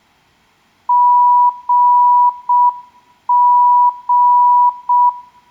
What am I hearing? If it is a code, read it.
Morse code (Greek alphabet), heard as a keyed tone, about 6 wpm, 980 Hz, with room echo. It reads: ΓΓ